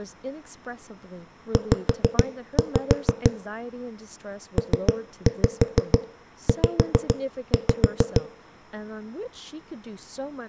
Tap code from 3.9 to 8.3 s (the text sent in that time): PZ